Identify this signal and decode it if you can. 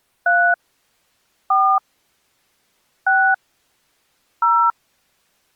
DTMF, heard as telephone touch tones, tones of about 280 ms. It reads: 3 4 6 0